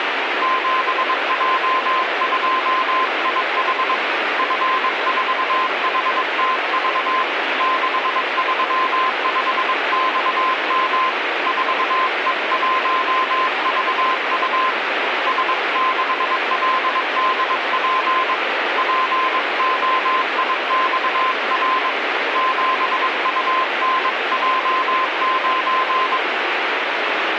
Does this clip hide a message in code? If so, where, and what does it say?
Yes: Morse code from 0.4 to 26.2 s, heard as a keyed tone, hand-sent with a paddle, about 22 wpm, 1040 Hz, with radio static. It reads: 7J2IH F4HTV 635XM 4E1VU S6LDP POIXR 7UNJ9